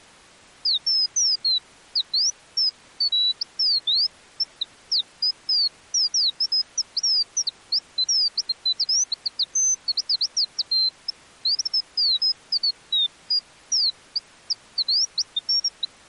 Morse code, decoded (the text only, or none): none